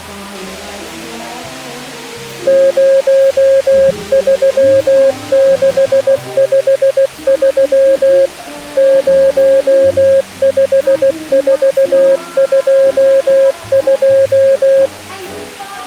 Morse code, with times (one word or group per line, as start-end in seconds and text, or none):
2.5-8.3 03653
8.8-14.9 05422